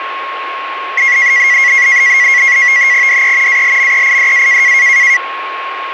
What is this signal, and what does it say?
NAVTEX (SITOR-B), 100 baud, 170 Hz shift, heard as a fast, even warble, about 2050 Hz centre, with radio static and a steady whistle near 1090 Hz. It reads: DE ALMEIDA